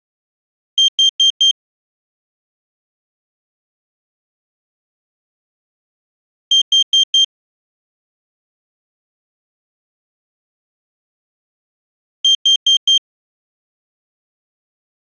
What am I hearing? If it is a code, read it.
Alarm pattern, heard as an alarm's beeps, played three times, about 3150 Hz. Temporal four. Carbon monoxide.